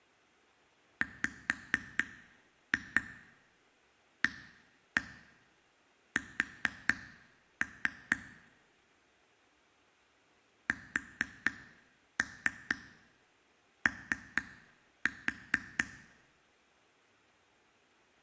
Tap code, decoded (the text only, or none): WAS SO